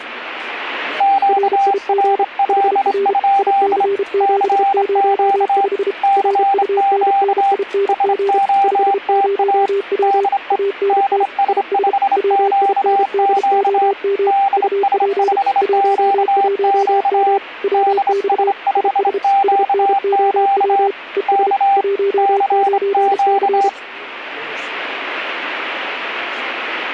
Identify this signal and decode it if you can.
Morse code, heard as two keyed tones. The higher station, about 26 wpm, 790 Hz: QRL? CQ CQ SOTA DE DS5QQ DS5QQ DS5QQ K CQ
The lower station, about 32 wpm, 400 Hz: RIG HR IC705 RUNNING 50W ANT IS WINDOM UP 11M WX IS SNOW ES 19C